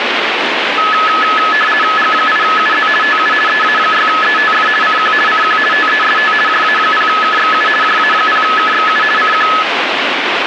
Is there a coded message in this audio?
Yes: RTTY (50 baud, 450 Hz shift) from 0.8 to 9.6 s, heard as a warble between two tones, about 1500 Hz centre, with radio static. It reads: G8UZ TU EA6ETF CQ CQ TEST JA0KXU JA0KXU CQ